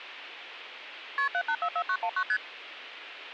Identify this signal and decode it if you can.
Multi-frequency trunk signalling (R1, as on North American trunks), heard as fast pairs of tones, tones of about 70 ms. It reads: KP 7844919 ST